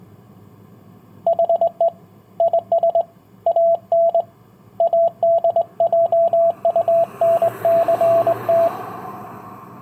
Morse code, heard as a keyed tone, hand-sent with a straight key, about 20 wpm, 670 Hz, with street noise. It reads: HE IS AN ADJUNCT